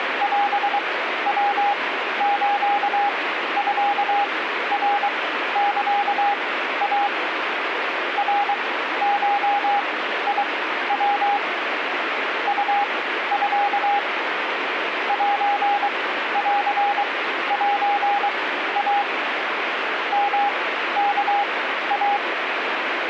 Morse code (Japanese Wabun code), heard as a keyed tone, machine-sent, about 23 wpm, spaced as for 13 wpm, 810 Hz, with radio static. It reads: オヤスミナサイ ナゴヤ ウミ センセイ ヨワイ